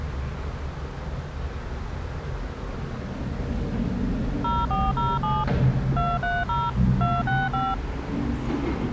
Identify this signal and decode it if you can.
DTMF, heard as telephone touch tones, dialled by machine, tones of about 210 ms, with the noise inside a lift. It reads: 0407 230 265